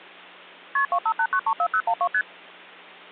Multi-frequency trunk signalling (R1, as on North American trunks), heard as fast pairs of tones, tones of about 70 ms, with hum. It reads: KP 258934012 ST